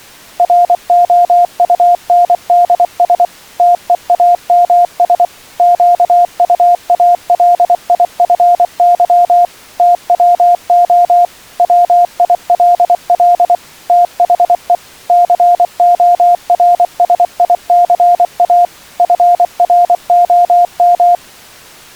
Morse code, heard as a keyed tone, machine-sent, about 24 wpm, 700 Hz. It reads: ROUNDS TEAMS QUALIFY TWO WILL THE CORSICA FROM